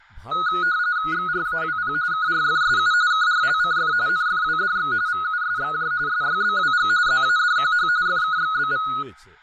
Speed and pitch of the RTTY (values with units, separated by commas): 45.45 baud, 170 Hz shift, 1360 Hz centre